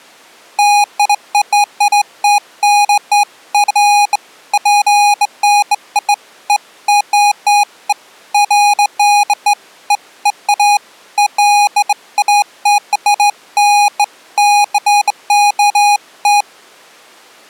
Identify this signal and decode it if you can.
Beeps of irregular length. There is no code.